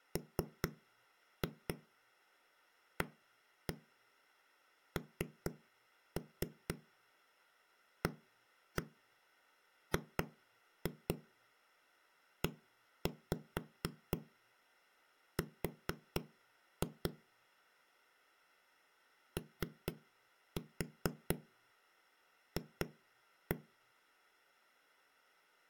Tap code, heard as knocks on a wall, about 4 knocks a second. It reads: MANAGER OF